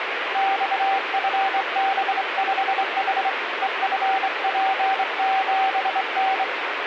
Morse code, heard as a keyed tone, hand-sent with a straight key, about 24 wpm, 770 Hz, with radio static. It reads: XFB5H EFP7N